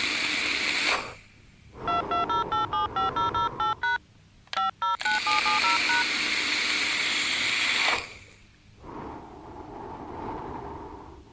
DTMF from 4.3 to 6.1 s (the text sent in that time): 509770#